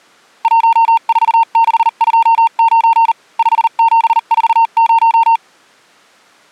Morse code, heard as a keyed tone, machine-sent, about 39 wpm, spaced as for 35 wpm, 910 Hz. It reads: 14629 5740